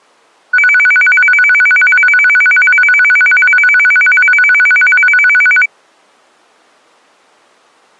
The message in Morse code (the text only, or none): none